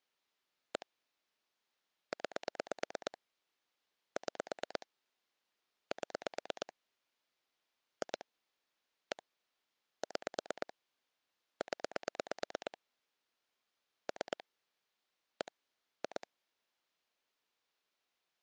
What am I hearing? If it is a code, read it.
Pulse dialling, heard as clicks on a phone line, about 8 pulses a second. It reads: 1 9 6 7 2 1 6 0 3 1 2